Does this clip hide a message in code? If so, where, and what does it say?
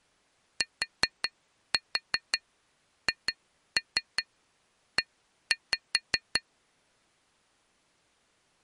Yes: tap code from 0.6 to 6.4 s, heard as taps on glass, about 5 knocks a second. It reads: THE